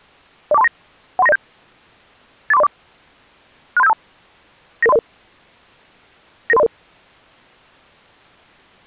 Five-tone selective call (EIA), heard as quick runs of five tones, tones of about 30 ms. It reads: 04239 13907 84304 63752 99300 99300